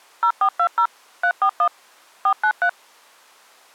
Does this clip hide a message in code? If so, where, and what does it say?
Yes: DTMF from 0.2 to 2.7 s, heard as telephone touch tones, dialled by machine, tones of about 80 ms. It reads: 0420 341 493